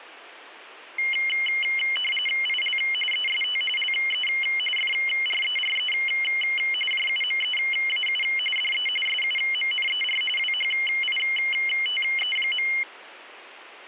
RTTY (45.45 baud, 850 Hz shift), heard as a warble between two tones, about 2550 Hz centre, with static crashes. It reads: IL EST LE FRERE JUMEAU DE SUMNER WHITE.